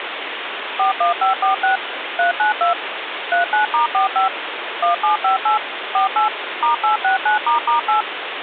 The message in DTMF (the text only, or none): 41546 392 39*45 1758 48 *869**8